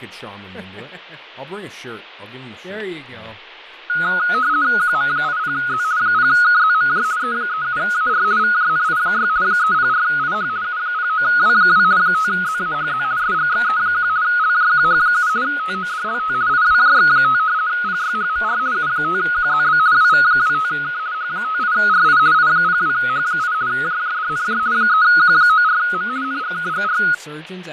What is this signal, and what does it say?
RTTY (50 baud, 170 Hz shift), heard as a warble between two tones, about 1360 Hz centre, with fading, static crashes and speech in English. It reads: QM80Z 0KZMJ E37AR VJNI6 304IH U09W2 5ZAHZ SGXE1 LJQH7 TODLT IWJX5 PYHMR U5QZB WV25K H58RI I02H8 JJDNJ 3Q94M NGKGR